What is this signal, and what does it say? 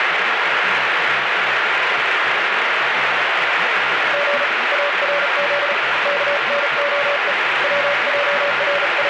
Morse code, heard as a keyed tone, hand-sent with a bug key, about 36 wpm, 570 Hz, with heavy radio static. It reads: G ARZ KNOE …